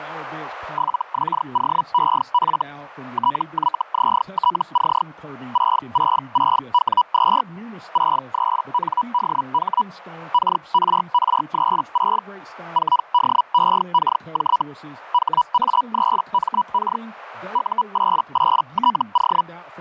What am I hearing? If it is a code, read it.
Hellschreiber (Feld-Hell, 122.5 baud), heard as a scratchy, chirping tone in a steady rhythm, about 980 Hz, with speech in English. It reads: 7XOEF TYZTC 666W2 63NDH KRR36 4DEKJ HA3MK U88TO